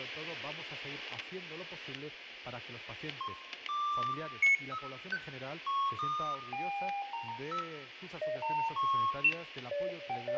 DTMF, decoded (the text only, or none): none